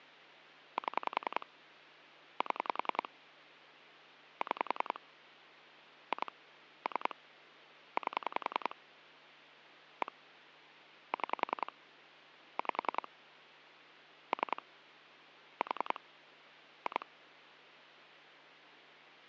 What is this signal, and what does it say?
Pulse dialling, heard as clicks on a phone line, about 10 pulses a second. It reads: 7 7 6 2 3 8 1 6 5 3 4 2